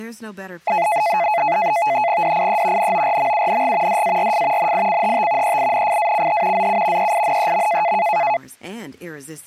NAVTEX (SITOR-B), 100 baud, 170 Hz shift, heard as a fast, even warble, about 770 Hz centre, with speech in French. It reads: DIE NORMUNG DARF NICHT EINFACH ZU EINEM